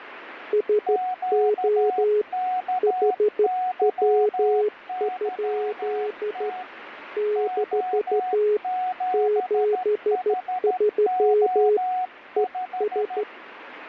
Morse code, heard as two keyed tones, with radio static. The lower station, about 13 wpm, 420 Hz: SO HW? - 73 ES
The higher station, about 13 wpm, 740 Hz: QKYYT O7HO5